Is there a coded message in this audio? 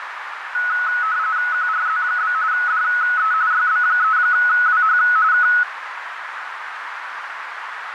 Yes: RTTY (45.45 baud, 170 Hz shift) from 0.5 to 5.6 s, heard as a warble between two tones, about 1380 Hz centre, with radio static and a narrow filter. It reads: QRZ? DE YB3WH K